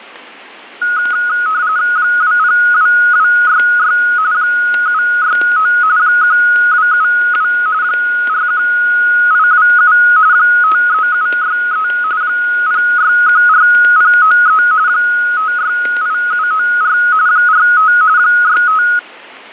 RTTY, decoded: 202266 769 1272 41827 53763 0614093 568794 45 65

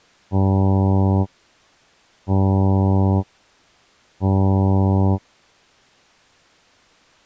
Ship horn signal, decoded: 3 short

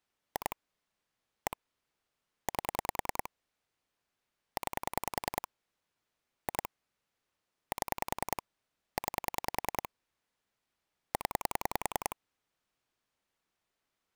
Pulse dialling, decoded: 2 1 8 9 2 7 9 0

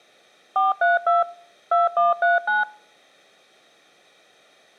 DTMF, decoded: 432 2139

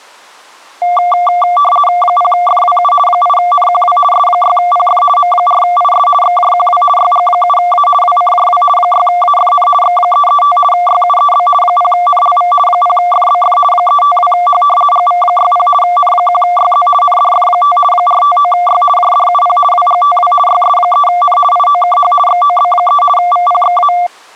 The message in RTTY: 0FWU 8NQW S6PF M4IS XJQW YG7A WCJW 6AFN X335 YUEB 0NLV 0FBF 352H GV60 N1YZ NDF5 459Y JDUP WGTW YS3N IOKH XOB3 VPXA

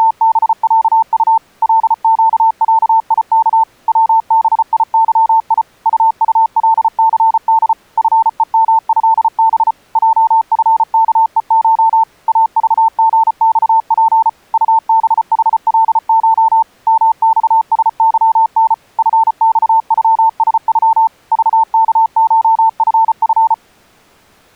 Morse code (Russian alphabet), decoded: … ЛЩЯИК ВБИЫИ УУЛЦД ФЕМЭБ ЙФКЕШ АЖГЬП УБХЛШ МЬСЫН ФЬЮСЮ ЖКШФФ

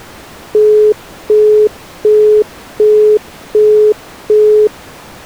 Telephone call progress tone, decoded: busy tone

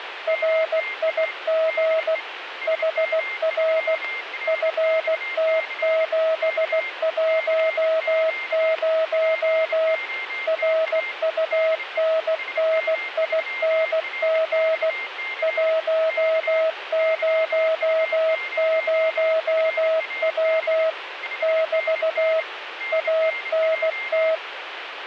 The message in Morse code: RIG HR FT710 RUNNING 100W <BT> ANT

